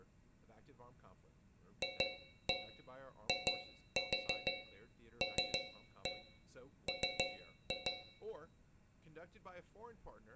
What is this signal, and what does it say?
Tap code, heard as taps on a metal pipe, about 6 knocks a second, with room echo and speech in English. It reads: FILM